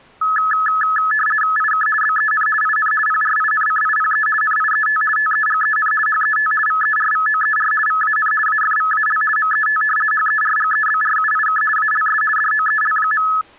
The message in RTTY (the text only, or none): IK BEN IN PRINCIPE NIET TEGEN HET VERVOER VAN AFVAL MET HERGEBRUIK ALS DOEL.